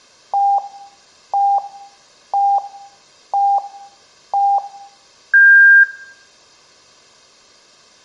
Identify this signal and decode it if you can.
Radio time signal (five pips and a higher one, as on Chinese radio), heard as pips.